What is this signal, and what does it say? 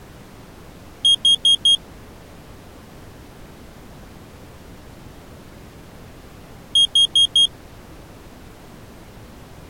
Alarm pattern, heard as an alarm's beeps, played twice, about 3250 Hz. Temporal four. Carbon monoxide.